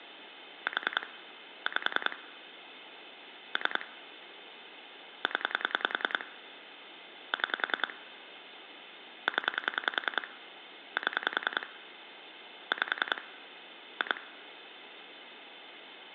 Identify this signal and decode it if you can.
Pulse dialling, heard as clicks on a phone line, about 10 pulses a second, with phone line noise. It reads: 4 5 3 0 6 0 7 5 2